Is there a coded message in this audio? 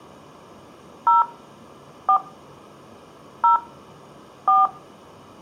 Yes: DTMF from 1.1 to 4.7 s, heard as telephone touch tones, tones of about 130 ms, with room echo. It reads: 0 4 0 4